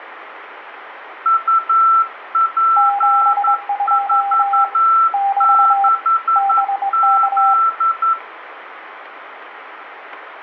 Morse code, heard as two keyed tones, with radio static and room echo. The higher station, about 11 wpm, 1340 Hz: UP46Z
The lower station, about 22 wpm, 800 Hz: 72 <BT> BK